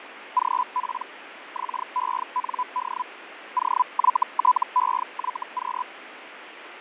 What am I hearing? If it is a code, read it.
Hellschreiber (Feld-Hell, 122.5 baud), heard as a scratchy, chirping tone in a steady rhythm, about 1000 Hz, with radio static and fading. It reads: GP XEND OYTEYQ